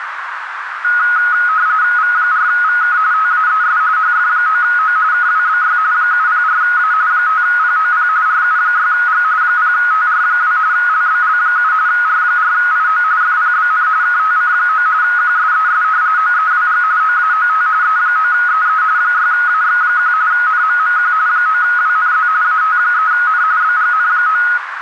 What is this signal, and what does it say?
RTTY (45.45 baud, 170 Hz shift), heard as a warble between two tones, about 1360 Hz centre, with radio static and a narrow filter. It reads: V4VK TAES HF9O KWBY 704A 5POP RU6G 0TR2 LBL7 R4IO FPBN KTC9 QSES OEWG OAOT E9EE 6AX1 NMMQ 9WNZ AT3N BGN9